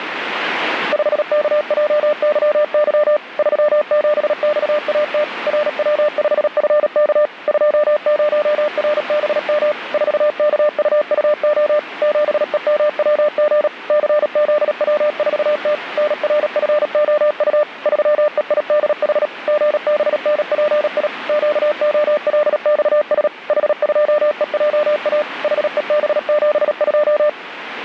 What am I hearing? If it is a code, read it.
Morse code, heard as a keyed tone, machine-sent, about 37 wpm, 600 Hz, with radio static. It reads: 5KJYY 37XAT RW5FK 20RBM 4KUUO 7EMWG CZW4T NRFOU 3EIDH GBNPI QOLXS H2EJA HEB72